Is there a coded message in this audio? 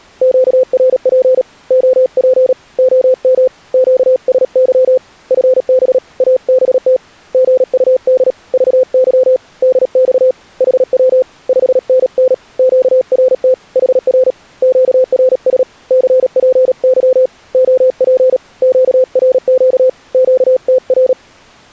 Yes: Morse code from 0.2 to 21.2 s, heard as a keyed tone, hand-sent with a paddle, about 37 wpm, 520 Hz. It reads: QRP OP OM QSY FB ABT GUD VY DX HW 5NN QRT HR QRS CPY OP QRQ QTR